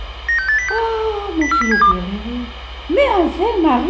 Five-tone selective call (CCIR), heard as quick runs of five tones, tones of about 100 ms. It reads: 96806 04072